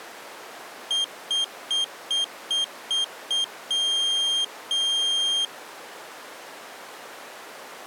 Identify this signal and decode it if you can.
Beep code, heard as a piezo beeper, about 3200 Hz. 7 short, 2 long.